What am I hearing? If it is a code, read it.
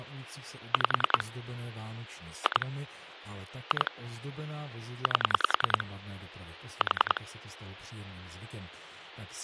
Pulse dialling, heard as clicks on a phone line, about 10 pulses a second, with speech in Czech. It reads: 5 2 2 8 4